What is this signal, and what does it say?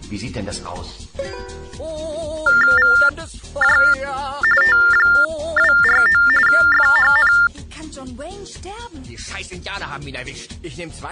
TTY/TDD text telephone tones (45.45 baud Baudot), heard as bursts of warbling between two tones, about 400 Hz shift, 1600 Hz centre. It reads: VJ T249 FHN